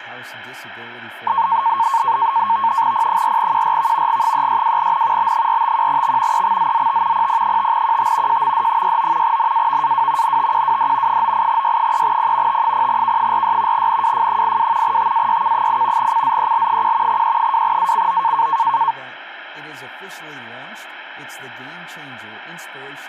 NAVTEX (SITOR-B), 100 baud, 170 Hz shift, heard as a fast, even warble, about 1000 Hz centre, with speech in English. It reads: P4QRV G362N B451X EXZZT PP5QT JMD69 NAVAW NTQWD 98Y3P T0K46 NWF82 TAYK8 CZEL1 E2ACO